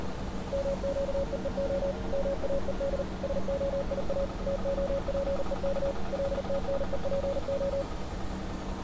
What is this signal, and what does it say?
Morse code (Hebrew alphabet), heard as a keyed tone, machine-sent, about 39 wpm, 550 Hz, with street noise. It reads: מקווה מאוד שהיא תהפוך לתנופה